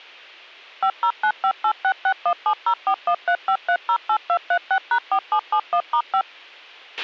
DTMF, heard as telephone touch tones, dialled by machine, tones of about 80 ms, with a squelch burst at the end. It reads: 50958661704135308236#4771*5